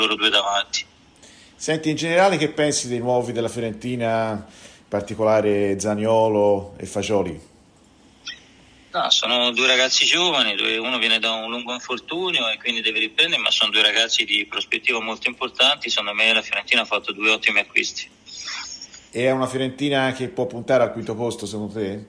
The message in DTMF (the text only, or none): none